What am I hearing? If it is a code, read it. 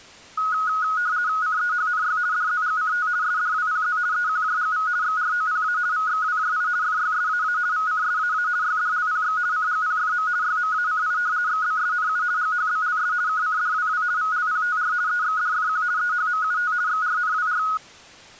RTTY (50 baud, 170 Hz shift), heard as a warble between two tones, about 1360 Hz centre. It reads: CEHNY DZGCT SDWPZ EQJGV XROPA VXWJI FYSAA VCSAA YDLPX CGPFM YMACI XBSNU GHBLS KCDWW VLPTR EXDFQ EHMUT XRNWR